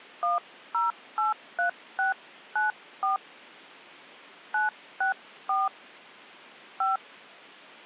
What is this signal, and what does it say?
DTMF, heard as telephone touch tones, dialled by hand, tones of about 150 ms. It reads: 1083694 964 5